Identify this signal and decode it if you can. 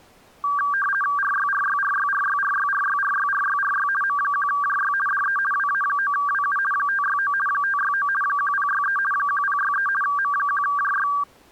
RTTY (50 baud, 450 Hz shift), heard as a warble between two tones, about 1370 Hz centre. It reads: RYRYRYRYRYRYRYRYRY M1JY DE WA9WU 569 569 1063 1063 M1JY